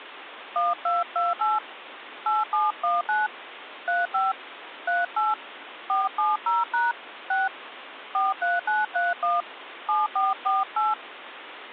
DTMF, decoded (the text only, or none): 1228 8719 35 38 470# 6 43931 7448